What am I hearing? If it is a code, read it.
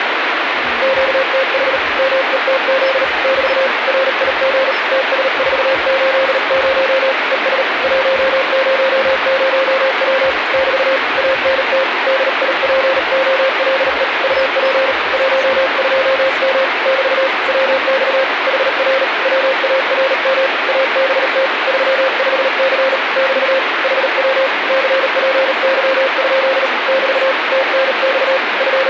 Morse code, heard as a keyed tone, hand-sent with a bug key, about 38 wpm, 530 Hz, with radio static. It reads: QTH METZ <BT> RIG TS480 ES 100W <BT> ANT DIPOLE UP 12M <BT> WX HR WARM ABT 35C <BT> HW CPY? <BT> TNX …